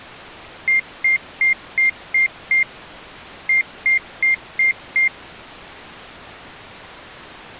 Beep code, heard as beeps from a small speaker, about 2100 Hz. 6-5.